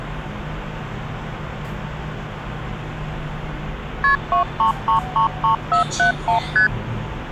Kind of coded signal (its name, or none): multi-frequency trunk signalling